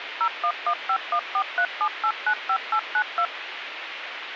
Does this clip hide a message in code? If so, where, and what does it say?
Yes: DTMF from 0.2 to 3.3 s, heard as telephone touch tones, dialled by machine, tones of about 70 ms, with phone line noise. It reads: 01151437895892